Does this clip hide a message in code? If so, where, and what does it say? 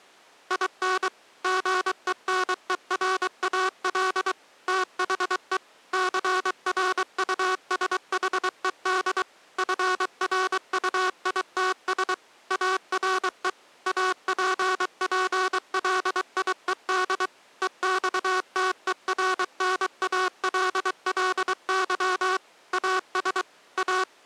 Yes: Morse code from 0.4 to 24.1 s, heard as a buzzer, machine-sent, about 23 wpm. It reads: IN GENERAL THE CRUSHED FRUITS ARE APPLIED EXTERNALLY AS A